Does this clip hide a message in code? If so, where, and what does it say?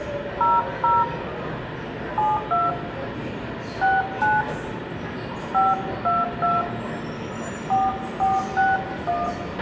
Yes: DTMF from 0.4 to 9.3 s, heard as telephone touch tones, dialled by hand, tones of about 190 ms, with radio hiss, a squelch burst at the end, room echo and the noise of a subway station. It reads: 00 72 69 522 4461